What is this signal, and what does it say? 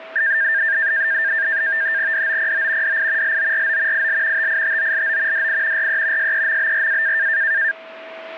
NAVTEX (SITOR-B), 100 baud, 170 Hz shift, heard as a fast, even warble, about 1700 Hz centre, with a steady whistle near 650 Hz. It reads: DOPO DI LORO IL TITOLO DI RE SEMBRA